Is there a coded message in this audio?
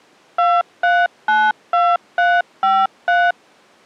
Yes: DTMF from 0.4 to 3.3 s, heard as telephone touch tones, dialled by machine, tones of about 230 ms. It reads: 2392353